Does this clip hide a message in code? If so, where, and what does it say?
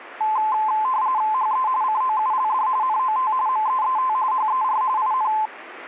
Yes: RTTY (45.45 baud, 170 Hz shift) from 0.2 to 5.5 s, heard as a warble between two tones, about 950 Hz centre. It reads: HE COULD NOT MEET HER IN